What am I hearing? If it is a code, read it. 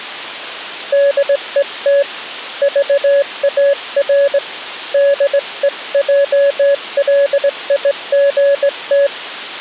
Morse code, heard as a keyed tone, hand-sent with a straight key, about 19 wpm, 560 Hz. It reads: DET VAR DEJLIGT